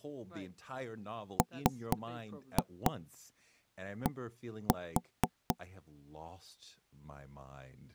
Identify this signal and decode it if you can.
Tap code, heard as knocks on wood, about 4 knocks a second, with speech in English. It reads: MD